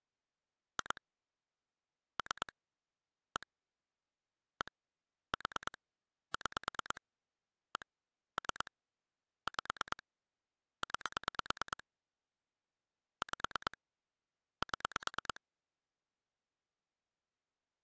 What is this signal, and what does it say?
Pulse dialling, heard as clicks on a phone line, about 9 pulses a second. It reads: 2 3 1 1 4 6 1 3 5 9 5 7